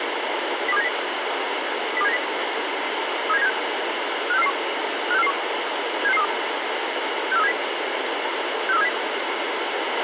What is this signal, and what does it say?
Five-tone selective call (EEA), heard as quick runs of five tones, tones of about 40 ms, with radio hiss and a squelch burst at the end. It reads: 02790 02790 37976 56441 56441 76632 64370 64370